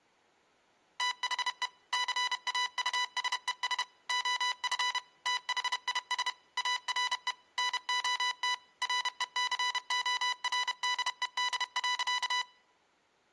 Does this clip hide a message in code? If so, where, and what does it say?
Yes: Morse code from 0.9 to 12.5 s, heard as electronic beeps, machine-sent, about 31 wpm, 990 Hz. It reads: THE CAUSES OF THIS ARE NOT RECORDED.